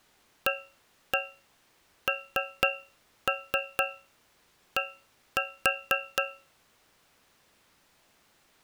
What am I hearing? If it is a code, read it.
Tap code, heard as taps on a metal pipe, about 4 knocks a second. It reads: AND